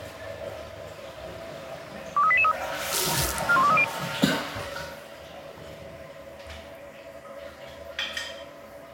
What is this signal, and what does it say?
Five-tone selective call (ZVEI), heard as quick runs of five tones, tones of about 70 ms, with the noise of a restroom. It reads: 23883 41230